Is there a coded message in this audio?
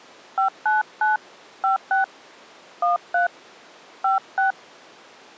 Yes: DTMF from 0.4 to 4.5 s, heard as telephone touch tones, dialled by hand, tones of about 140 ms. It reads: 599 56 13 56